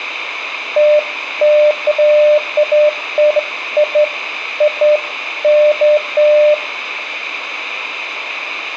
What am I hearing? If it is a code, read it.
Beeps of irregular length, with radio hiss and room echo. There is no code.